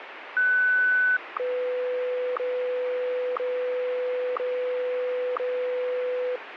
Radio time signal (WWVH, Hawaii), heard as ticks, one a second, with radio static.